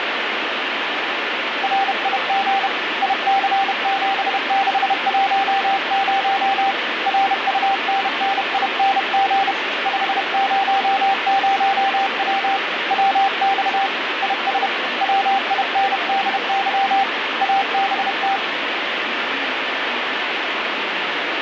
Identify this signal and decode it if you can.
Morse code, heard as a keyed tone, hand-sent with a paddle, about 31 wpm, 780 Hz, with radio static. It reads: RIG IC7610 RUNNING 500W WX IS WINDY ABT